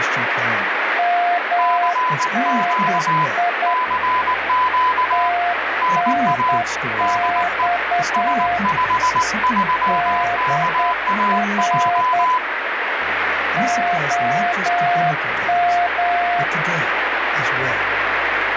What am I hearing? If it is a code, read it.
Morse code, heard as two keyed tones, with radio static. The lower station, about 9 wpm, 700 Hz: MNI TNX DR OM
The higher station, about 19 wpm, 1000 Hz: CQ CQ NA DE S53KAJ